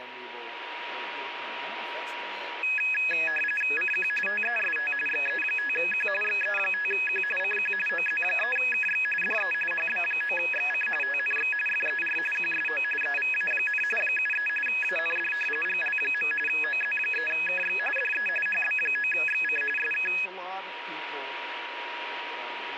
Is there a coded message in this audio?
Yes: RTTY (45.45 baud, 850 Hz shift) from 2.6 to 20.3 s, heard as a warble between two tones, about 2100 Hz centre, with radio static and a steady whistle near 960 Hz. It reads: CQ TEST XE5Q XE5Q CQ OZ3KX DE HB9XC TNX FER QSO EVA, 73 AND GL. OZ3KX DE HB9XC SK